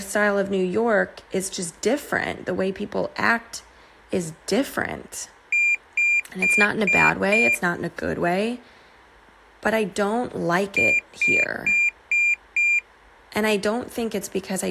Beep code, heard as a piezo beeper, played twice, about 2400 Hz, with speech in English. 5 short. In AMI BIOS tables: processor failure; in Dell tables: CMOS battery failure.